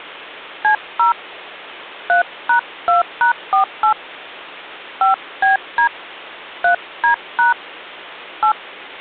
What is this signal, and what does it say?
DTMF, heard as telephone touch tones, dialled by hand, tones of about 120 ms. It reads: C0 3#2#48 5BD 3D# 8